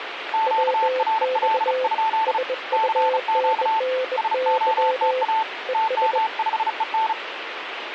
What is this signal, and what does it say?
Morse code, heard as two keyed tones, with radio static. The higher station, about 35 wpm, 880 Hz: QRL? CQ SOTA TM5EN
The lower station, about 21 wpm, 510 Hz: WX SUNNY ES